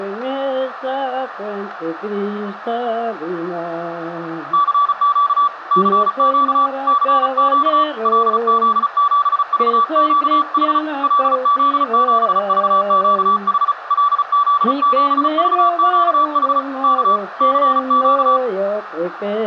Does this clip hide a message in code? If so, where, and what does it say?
Yes: Morse code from 4.5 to 18.4 s, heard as a keyed tone, hand-sent with a paddle, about 35 wpm, 1150 Hz, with radio static. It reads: CQ CQ CQ LZ7VQH LZ7VQH LZ7VQH K CQ